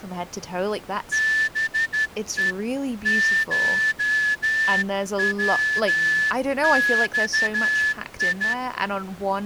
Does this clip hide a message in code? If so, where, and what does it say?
Yes: Morse code (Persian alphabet) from 1.1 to 8.6 s, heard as a whistle, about 12 wpm, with speech in English. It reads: به شوخی